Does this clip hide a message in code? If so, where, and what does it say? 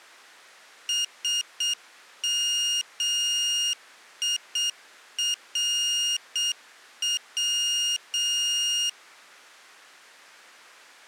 Yes: Morse code (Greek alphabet) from 0.8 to 9.0 s, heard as a high beeper, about 7 wpm, 2850 Hz. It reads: ΣΜΙΡΩ